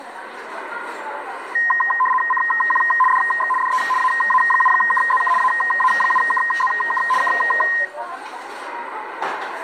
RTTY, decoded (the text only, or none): CQ DX DE AA7KZK AA7KZK K